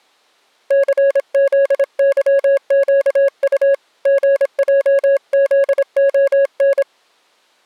Morse code, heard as a keyed tone, hand-sent with a paddle, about 26 wpm, 550 Hz. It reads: CZYQU GJZON